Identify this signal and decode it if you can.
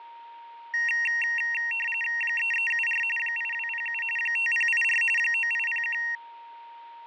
RTTY (45.45 baud, 850 Hz shift), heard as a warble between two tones, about 2300 Hz centre, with fading and a steady whistle near 930 Hz. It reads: 3374 8207 5084 9801